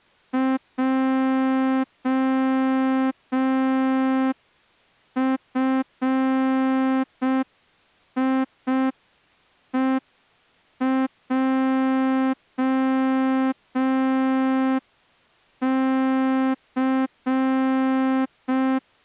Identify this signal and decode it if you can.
Morse code, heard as a horn, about 5 wpm. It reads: JFIEJC